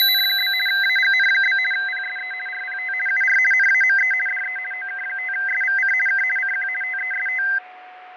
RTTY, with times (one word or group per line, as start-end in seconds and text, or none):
0.0-0.5 …
0.7-1.6 AGN?
1.7-2.3 PSE
2.5-2.9 RPT
3.1-3.4 UR
3.5-4.1 NAME
4.3-4.6 DE
4.7-5.9 OK5SVC
6.1-6.2 K
6.4-6.7 CQ
6.8-7.4 TEST